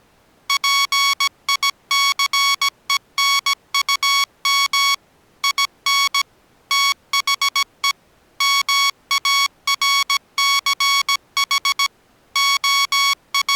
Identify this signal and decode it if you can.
Morse code, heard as electronic beeps, machine-sent, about 17 wpm, 1120 Hz. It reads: PICENUM IN THE MARCH …